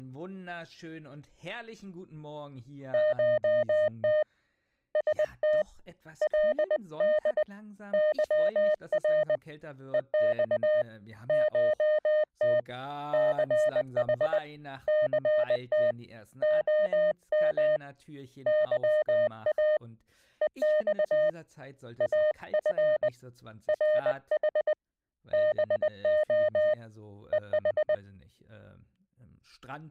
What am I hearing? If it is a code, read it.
Morse code (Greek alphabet), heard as a keyed tone, hand-sent with a paddle, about 20 wpm, 610 Hz. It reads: ΧΤ ΣΤ ΛΔ ΥΡ ΕΞ ΧΤ ΘΗ ΘΤ ΟΜ ΥΑ ΕΞ ΑΦ ΡΗ ΒΟ ΕΗ